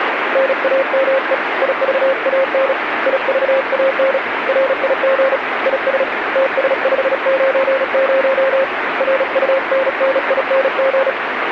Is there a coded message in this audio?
Yes: Morse code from 0.3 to 11.2 s, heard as a keyed tone, hand-sent with a bug key, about 36 wpm, 540 Hz, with radio static. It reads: NAME IVAN IVAN RIG IS TS590 RUNNING